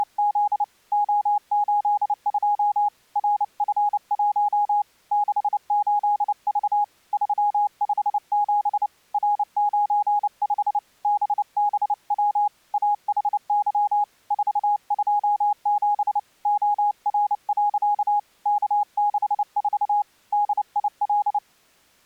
Morse code, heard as a keyed tone, hand-sent with a paddle, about 29 wpm, 830 Hz. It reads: … O82 RF1 68V 357 R95 BBW AHY 427 OR. K64 DIL